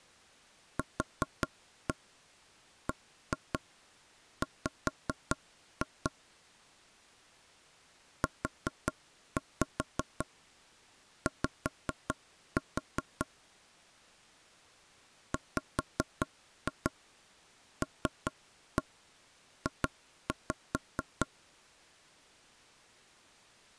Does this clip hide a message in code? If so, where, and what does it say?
Yes: tap code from 0.8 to 21.3 s, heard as knocks on wood, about 5 knocks a second. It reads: QBW UY WLJ